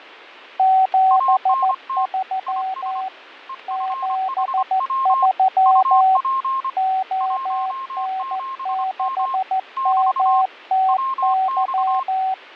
Morse code, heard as two keyed tones, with fading. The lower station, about 14 wpm, 760 Hz: 73 73 ON6MTY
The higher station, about 25 wpm, 1060 Hz: ANT IS EFHW UP 17M <BT> WX